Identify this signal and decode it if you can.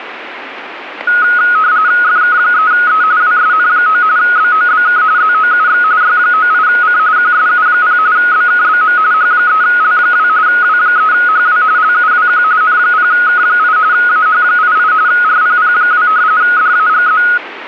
RTTY (45.45 baud, 170 Hz shift), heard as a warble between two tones, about 1360 Hz centre, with radio static. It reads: FK3E WSN9 BOBK ZOUX Y98C QSU0 BKBM H3L2 W3HW LUWQ N0K8 AH88 RPP2 DAGZ